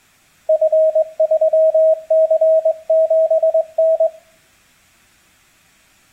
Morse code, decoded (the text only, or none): F3C7N